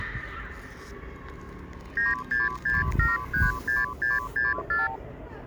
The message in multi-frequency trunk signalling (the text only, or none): 966736664